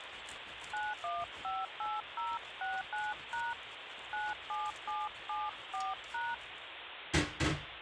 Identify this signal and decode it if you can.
DTMF, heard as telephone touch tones, dialled by hand, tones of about 200 ms, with phone line noise and kitchen noise. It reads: 9158069# 97774#